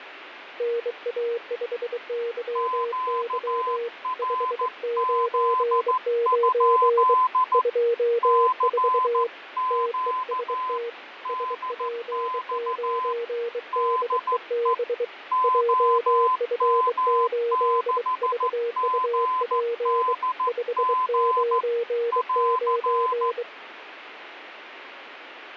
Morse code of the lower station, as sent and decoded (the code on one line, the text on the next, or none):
-. .- ..... -.-- -.-- / ..... ----. ----. / ..--- ....- / - . ... - / ... .--. ----. -.. . -... / .--- ..-. ---.. ...- ..- .--. / ..... ----. ----.
NA5YY 599 24 TEST SP9DEB JF8VUP 599